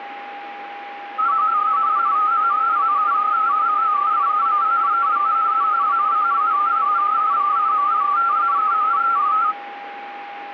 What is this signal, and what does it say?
Multi-tone FSK (Olivia or MFSK type), about 250 Hz wide, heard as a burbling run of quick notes, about 31.25 baud, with a steady whistle near 810 Hz.